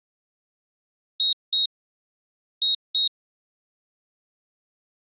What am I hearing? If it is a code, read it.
Beep code, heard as a piezo beeper, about 3800 Hz. 2-2.